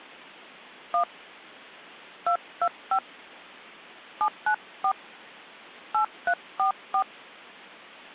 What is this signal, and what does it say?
DTMF, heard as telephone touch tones, dialled by hand, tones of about 90 ms. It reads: 1 225 794 8344